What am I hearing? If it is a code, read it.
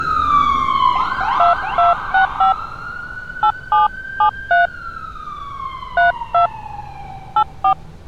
DTMF, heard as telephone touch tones, dialled by hand, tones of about 110 ms, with street noise. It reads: 2265 8773 32 84